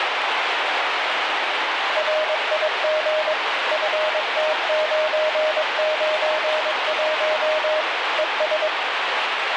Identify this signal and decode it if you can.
Morse code, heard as a keyed tone, machine-sent, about 22 wpm, 620 Hz, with heavy radio static and the noise of a park. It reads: RIG FT991 ES